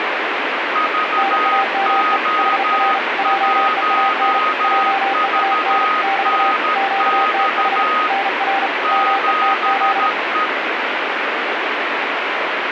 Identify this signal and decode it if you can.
Morse code, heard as two keyed tones, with heavy radio static. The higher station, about 13 wpm, 1250 Hz: VO1VNX 7E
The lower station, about 35 wpm, 780 Hz: NAME HR JEAN JEAN <BT> QTH NR METZ